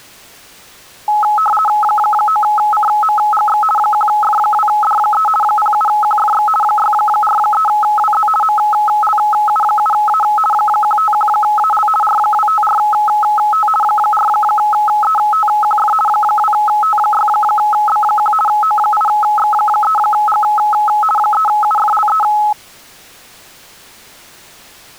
RTTY (50 baud, 450 Hz shift), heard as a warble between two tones, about 1070 Hz centre. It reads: 9CMGX 1F2D3 07QFX 643WZ MLU7A 151AL R254T 4ETQF 2T6B1 O8X3G 3UFLE